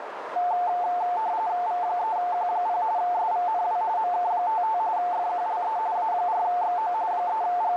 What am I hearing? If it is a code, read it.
RTTY (45.45 baud, 170 Hz shift), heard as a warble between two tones, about 800 Hz centre, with radio static and a narrow filter. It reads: V3Q0 SVNW MK55 FQLE A4XO …